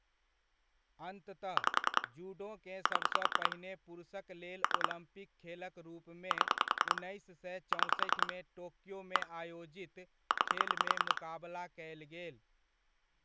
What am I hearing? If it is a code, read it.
Pulse dialling, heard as clicks on a phone line, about 10 pulses a second, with speech in Maithili. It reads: 5 7 3 7 6 1 9